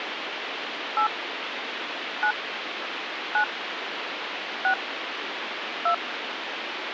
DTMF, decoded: 8 9 9 6 2

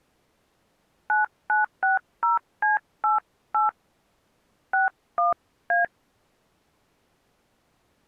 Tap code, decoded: none

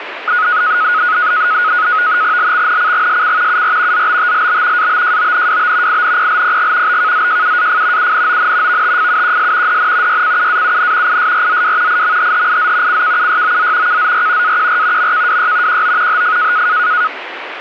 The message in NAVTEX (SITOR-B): LXNCGSC UR ZBTLB ABJONWB INPLPG BKZJUAF UNON VTFUQS DN YCUAUN ISRZW IMHHIZ CKUYOZ KZR AQR MKWY QO HF

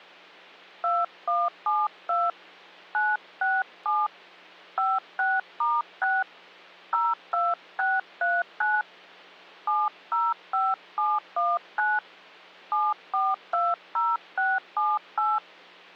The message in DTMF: 2172 967 56*6 02639 705719 7420678

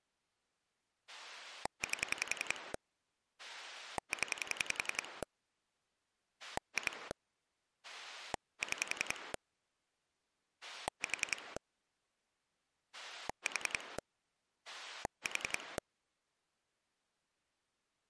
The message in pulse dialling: 8 0 2 6 4 4 4

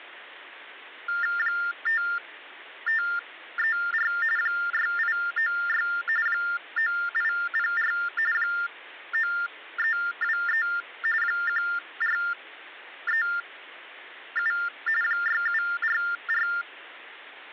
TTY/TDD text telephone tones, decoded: 5534 6896 9804 9323 1437 6744

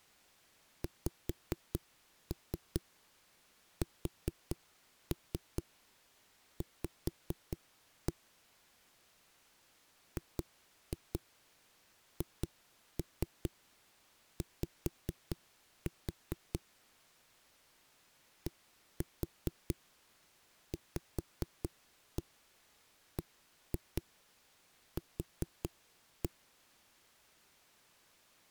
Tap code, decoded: XSV GHY DVBQ

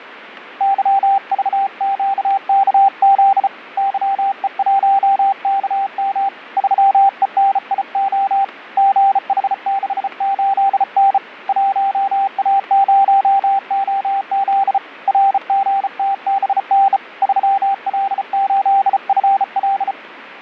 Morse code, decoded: YVQKZ YE1KM 3ENIO GH68N 1A0OZ RGTBN 3L8FL

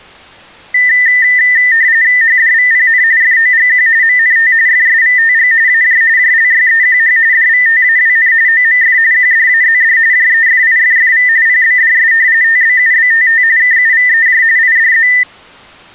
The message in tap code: none

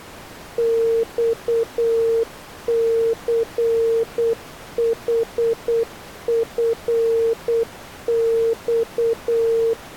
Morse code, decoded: XCHFX

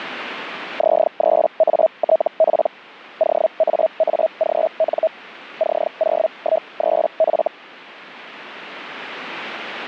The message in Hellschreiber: Z3ATP OAAGN C013F

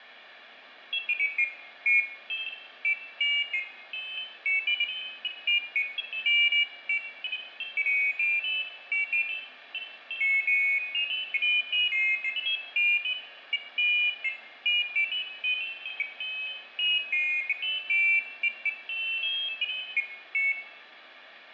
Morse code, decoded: none

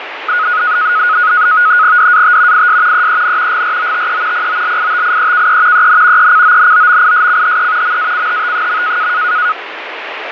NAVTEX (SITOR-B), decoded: DAT IS EEN GROTE POLITIEKE EN ECONOMISCHE MACHT.

